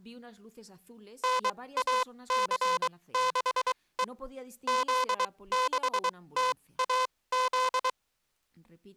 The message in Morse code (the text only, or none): NAC6E Z6TAZ